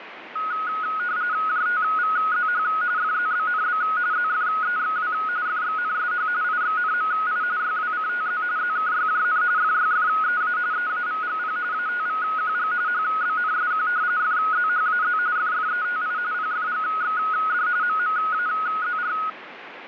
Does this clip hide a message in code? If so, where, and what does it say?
Yes: RTTY (45.45 baud, 170 Hz shift) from 0.4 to 19.3 s, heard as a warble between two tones, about 1360 Hz centre, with radio static. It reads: JTVZH FZBNB ZFEXW FXNSH IXNMI YWCTZ ZKYJN FYFEA EAVGP ATVQG HBNSQ FZHAZ FFETI PFGXD MMAZR